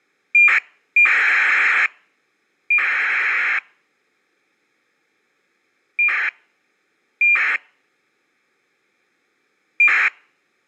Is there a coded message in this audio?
Yes: ACARS aircraft data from 0.3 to 10.1 s, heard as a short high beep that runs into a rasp, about 2400 baud.